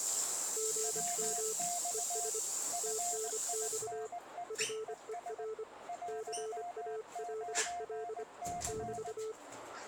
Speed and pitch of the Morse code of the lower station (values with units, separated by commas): 25 wpm, 440 Hz